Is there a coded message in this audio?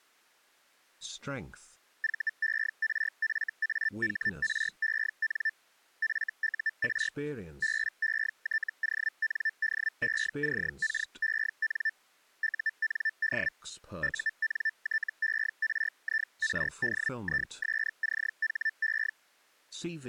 Yes: Hellschreiber (Feld-Hell, 122.5 baud) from 2.0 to 19.1 s, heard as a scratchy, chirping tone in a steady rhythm, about 1750 Hz. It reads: VERFAHREN FUR BETONDECKEN UND UNTERIRDISCHE